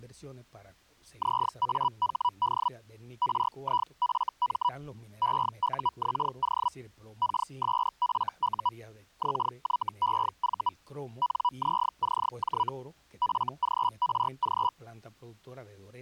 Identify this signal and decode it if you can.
Hellschreiber (Feld-Hell, 122.5 baud), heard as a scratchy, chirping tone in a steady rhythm, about 980 Hz. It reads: ZAHD RIFM EUXO KSFU XYEV NZCJ FGRG